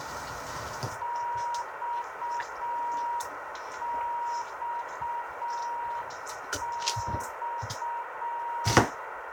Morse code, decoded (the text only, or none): XXX